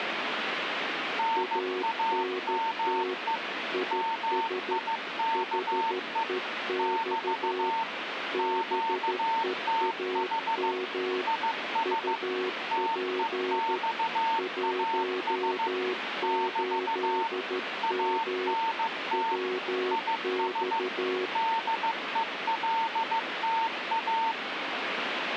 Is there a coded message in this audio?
Yes: Morse code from 1.1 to 24.4 s, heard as two keyed tones, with radio static. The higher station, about 15 wpm, 900 Hz: NAME MIKE <BT> QTH IS TEXAS <BT> ANT IS DELTA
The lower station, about 13 wpm, 370 Hz: ANT IS HEX BEAM UP 18M WX